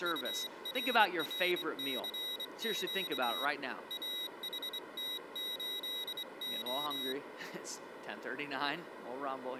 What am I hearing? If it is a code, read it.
Morse code, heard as a high beeper, hand-sent with a straight key, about 24 wpm, 3850 Hz, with speech in English. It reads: URRCQ AHT8O